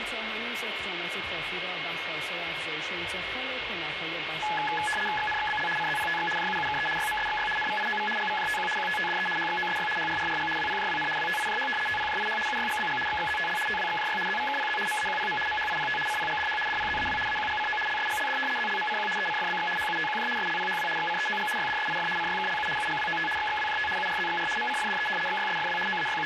RTTY (75 baud, 850 Hz shift), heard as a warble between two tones, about 1270 Hz centre, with radio static and a steady whistle near 2160 Hz. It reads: XNXBL CZPTX JUUKE YMSXY NVIOV GVJTQ QTTDE HXOSY HRRRG WPJWN WTIJH TPJIH UYGBG XXZTL TWXJY ZVKPZ MAQPM MHIPT CPGDH DPZAW AQGCO LSGLD ZLMCQ ECFBX HUTQJ SLPHW XCEOG YDSIF CYKLU UGWOT XXWJT URZXR MCFDE XYSFW …